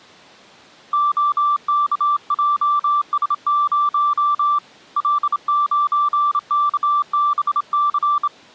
Morse code, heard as a keyed tone, hand-sent with a straight key, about 27 wpm, 1170 Hz. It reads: OKJS0 L9KBC